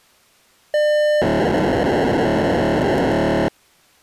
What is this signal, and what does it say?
POCSAG pager data (1200 baud), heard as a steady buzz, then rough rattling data.